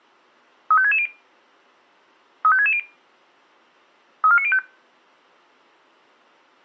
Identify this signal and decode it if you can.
Five-tone selective call (ZVEI), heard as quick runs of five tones, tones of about 70 ms. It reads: 35660 35660 34905